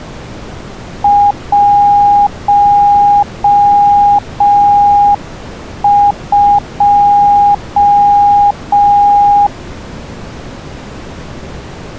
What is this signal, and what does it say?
Morse code, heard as a keyed tone, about 5 wpm, 820 Hz. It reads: 12